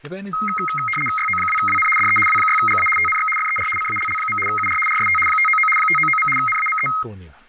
RTTY (75 baud, 850 Hz shift), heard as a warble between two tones, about 1700 Hz centre, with static crashes and speech in English. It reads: YO2WN DE W6GA TNX FER CALL. UR RST 599 599. NAME